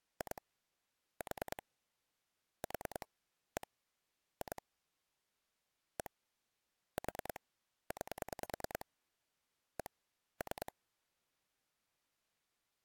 Pulse dialling, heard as clicks on a phone line, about 10 pulses a second. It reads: 2 4 4 1 2 1 4 9 1 3